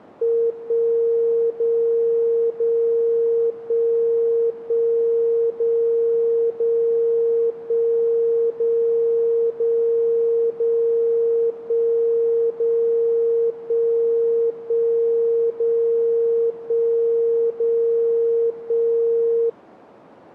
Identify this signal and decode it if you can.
Radio time signal (DCF77), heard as a tone whose level steps once a second, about 460 Hz. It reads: 1 0 0 1 1 0 0 1 0 0 0 1 0 1 1 0 1 0 1